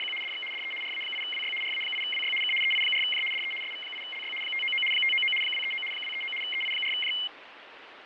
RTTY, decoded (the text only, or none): … DX DE RA8WY RA8WY K EI4J DE SV8LY 599 599 239 239 EI4J